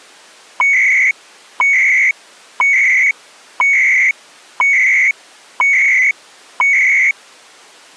Radio time signal (CHU, Canada), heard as beeps and data bursts, one a second.